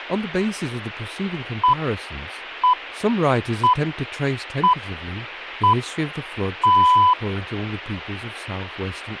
Radio time signal (six pips, as the Greenwich Time Signal), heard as pips, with speech in English.